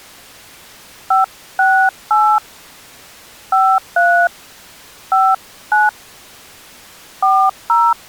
DTMF, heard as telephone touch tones, dialled by hand, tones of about 230 ms. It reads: 568 53 59 40